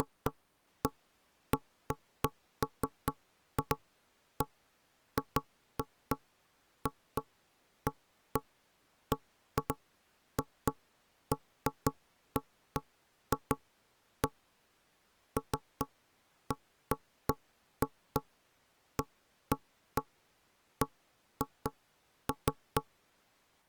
Irregular knocks on wood. There is no code.